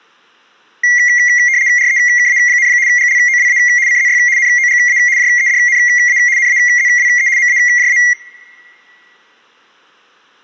RTTY (75 baud, 170 Hz shift), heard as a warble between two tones, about 2050 Hz centre. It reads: REKA, GLOWA CZY NOGA JEDNA NAZWE MAJA